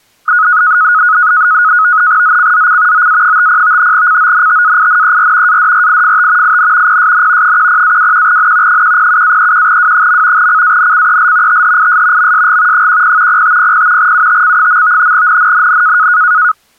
NAVTEX (SITOR-B), 100 baud, 170 Hz shift, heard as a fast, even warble, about 1360 Hz centre. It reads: ZCZC OA50 CONTAINER ADRIFT IN PSN 10-21N 107-31W. CANCEL THIS MSG 10 0500 UTC. NNNN